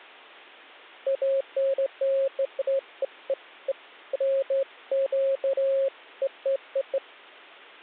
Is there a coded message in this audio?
No, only beeps of irregular length.